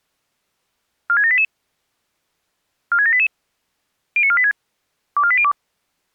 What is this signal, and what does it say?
Five-tone selective call (ZVEI), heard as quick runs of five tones, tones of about 70 ms. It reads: 46788 46788 09486 24802